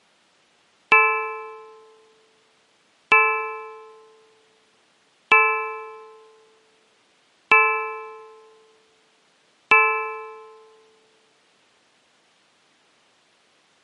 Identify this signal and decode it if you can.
Clock strike, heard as a bell. 5. Five o'clock.